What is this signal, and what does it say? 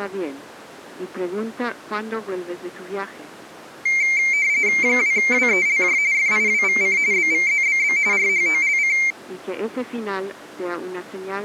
RTTY (45.45 baud, 170 Hz shift), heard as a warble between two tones, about 2200 Hz centre. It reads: 2WELJ FIWVC BVZBB RHOLC